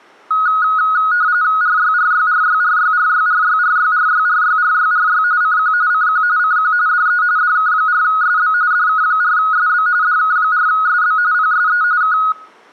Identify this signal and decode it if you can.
RTTY (45.45 baud, 170 Hz shift), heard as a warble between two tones, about 1360 Hz centre, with room echo. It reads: RYRYRYRYRYRYRYRYRYRYRY CQ CQ CQ DE DK4SB DK4SB DK4SB PSE K